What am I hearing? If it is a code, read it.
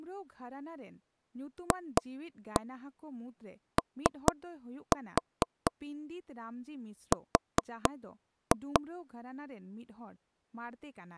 Tap code, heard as knocks on wood, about 4 knocks a second, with speech in Santali. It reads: FOR